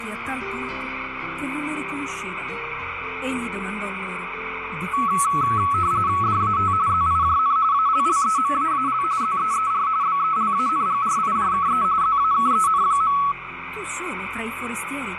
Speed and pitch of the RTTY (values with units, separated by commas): 45.45 baud, 170 Hz shift, 1210 Hz centre